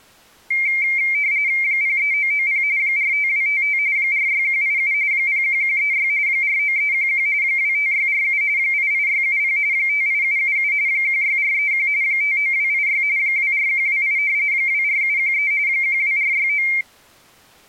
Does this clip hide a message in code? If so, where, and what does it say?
Yes: RTTY (45.45 baud, 170 Hz shift) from 0.5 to 16.8 s, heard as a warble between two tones, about 2200 Hz centre. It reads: 03990 45255 46187 01136 49311 25647 88670 58777 16431 59286 24128 24713 12469